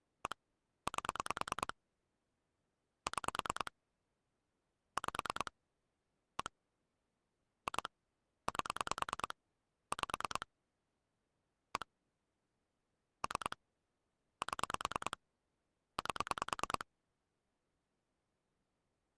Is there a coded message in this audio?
Yes: pulse dialling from 0.3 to 16.8 s, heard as clicks on a phone line, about 9 pulses a second. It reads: 1 8 6 5 1 2 8 5 1 3 7 8